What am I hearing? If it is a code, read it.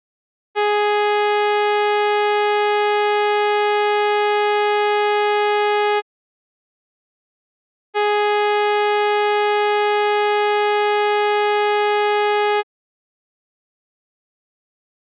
Ship horn signal, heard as a ship's horn, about 420 Hz. 2 long. At sea: a vessel under power that has stopped in fog.